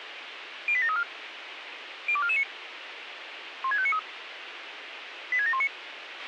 Five-tone selective call (ZVEI), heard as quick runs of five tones, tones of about 70 ms, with radio hiss and a squelch burst at the end. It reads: 08734 02449 16593 86719